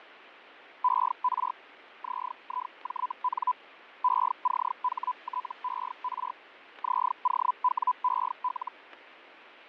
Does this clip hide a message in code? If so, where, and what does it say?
Yes: Hellschreiber (Feld-Hell, 122.5 baud) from 0.8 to 8.7 s, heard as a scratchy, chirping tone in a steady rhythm, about 1000 Hz, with radio static and fading. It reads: ER ZIJN ECHTER ZOWEL